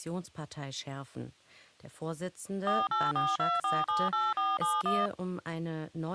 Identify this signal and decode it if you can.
DTMF, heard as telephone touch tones, dialled by machine, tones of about 200 ms. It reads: 4842478471